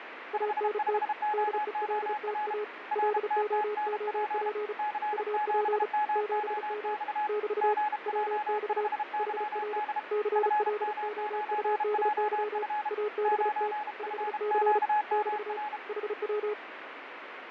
Morse code, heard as two keyed tones, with radio static and fading. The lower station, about 35 wpm, 420 Hz: ANT DELTA LOOP UP 7M <BT> WX HR CLOUDY ABT 5C <BT> HW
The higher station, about 32 wpm, 840 Hz: 55OOR RTTNP C7MOX GJ5YD FM9JF 9FQMR